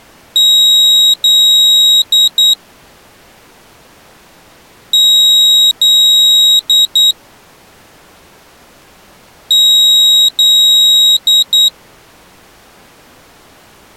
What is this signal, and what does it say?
Beep code, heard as a piezo beeper, played three times, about 3800 Hz. 2 long, 2 short.